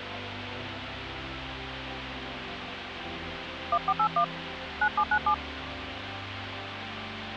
DTMF, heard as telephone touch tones, dialled by hand, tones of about 70 ms, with phone line noise. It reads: 1481 9797